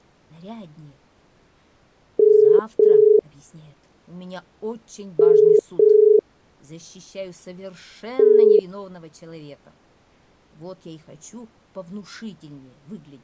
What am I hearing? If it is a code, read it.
Telephone call progress tone (as in the UK, Ireland, Australia and similar networks), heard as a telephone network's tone, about 430 Hz. Ringback tone.